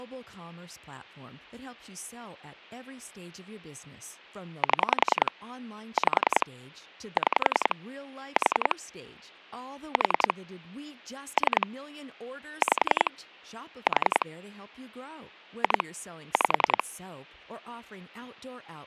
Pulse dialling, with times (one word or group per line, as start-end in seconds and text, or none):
4.6-5.3 7
6.0-6.5 5
7.2-7.8 6
8.4-8.8 4
9.9-10.3 4
11.4-11.7 3
12.6-13.1 5
13.9-14.3 4
15.6-15.8 2
16.3-16.8 5